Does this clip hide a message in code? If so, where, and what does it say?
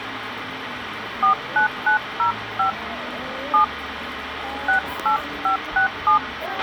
Yes: DTMF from 1.2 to 6.2 s, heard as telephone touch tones, dialled by hand, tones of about 110 ms, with radio hiss, a squelch burst at the end and the noise of a restaurant. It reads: 49905 7 68567